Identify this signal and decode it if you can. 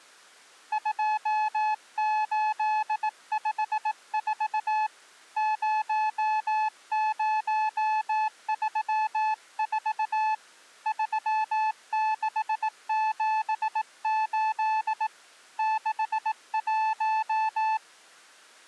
Morse code, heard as a keyed tone, hand-sent with a bug key, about 18 wpm, 870 Hz. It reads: 2854 0034 3678 61